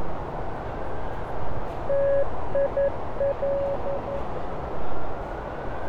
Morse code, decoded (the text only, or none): TIL